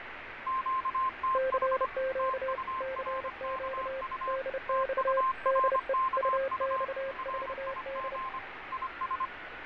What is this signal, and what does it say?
Morse code, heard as two keyed tones, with radio static, fading and street noise. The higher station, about 25 wpm, 1050 Hz: QTH TURKU TURKU RIG IS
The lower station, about 30 wpm, 530 Hz: CQ CQ DX DE UX4D